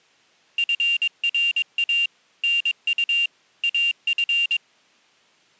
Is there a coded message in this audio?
Yes: Morse code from 0.5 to 4.6 s, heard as a high beeper, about 22 wpm, 2800 Hz. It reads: FRA NU AF